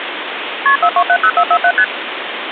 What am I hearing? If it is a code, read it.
Multi-frequency trunk signalling (R1, as on North American trunks), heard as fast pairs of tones, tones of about 70 ms, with phone line noise. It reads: KP 4270447 ST